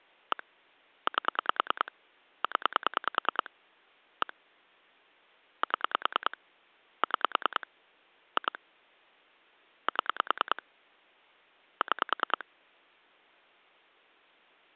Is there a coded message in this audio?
Yes: pulse dialling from 0.3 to 12.4 s, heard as clicks on a phone line, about 10 pulses a second. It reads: 1 8 0 1 7 6 2 7 6